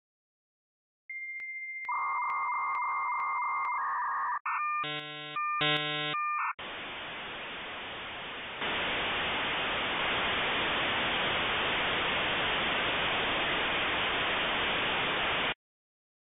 Dial-up modem handshake (V.34 or later), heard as a whistle, warbles, then hiss.